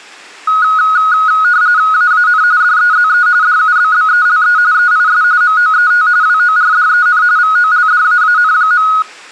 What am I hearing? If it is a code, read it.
RTTY (45.45 baud, 170 Hz shift), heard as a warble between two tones, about 1360 Hz centre. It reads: AAN DEZE DUBBELE EIS MOET WORDEN VOLDAAN.